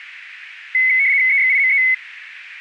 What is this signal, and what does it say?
RTTY (75 baud, 170 Hz shift), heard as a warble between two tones, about 2100 Hz centre, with radio static. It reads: EXIME